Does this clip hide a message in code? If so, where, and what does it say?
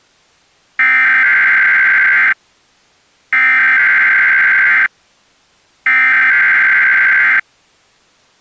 Yes: Emergency Alert System (SAME) tones (header bursts) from 0.8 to 7.4 s, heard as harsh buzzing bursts, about 520.83 baud.